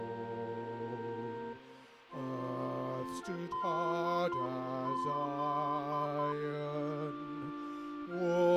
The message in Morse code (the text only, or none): DZ